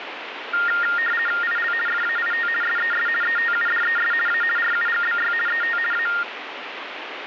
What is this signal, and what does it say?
RTTY (50 baud, 450 Hz shift), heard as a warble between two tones, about 1650 Hz centre, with radio static. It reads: IL FAIT SES ETUDES A RUGBY ET A